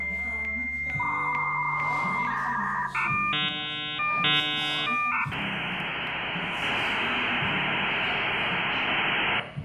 Dial-up modem handshake (V.34 or later), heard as a whistle, warbles, then hiss, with room echo and the noise of a cafe.